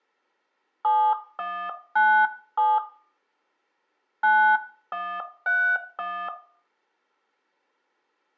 DTMF, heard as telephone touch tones, dialled by hand, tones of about 290 ms, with room echo. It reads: 7197 9131